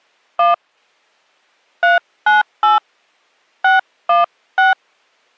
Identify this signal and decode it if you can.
DTMF, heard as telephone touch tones, dialled by hand, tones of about 150 ms. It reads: 1 398 616